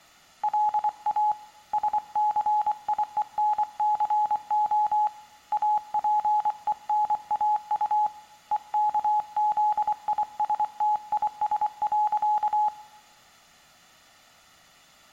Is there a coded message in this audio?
Yes: Morse code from 0.4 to 12.7 s, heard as a keyed tone, hand-sent with a paddle, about 24 wpm, 840 Hz, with room echo. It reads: LA SCIENCO APENAU EKZISTIS.